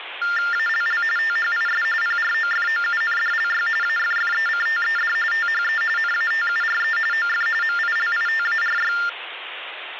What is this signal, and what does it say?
TTY/TDD text telephone tones (45.45 baud Baudot), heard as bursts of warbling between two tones, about 400 Hz shift, 1600 Hz centre, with phone line noise. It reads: ALL THIS PROFOUNDLY AFFECTED THE NATURE OF MILITARY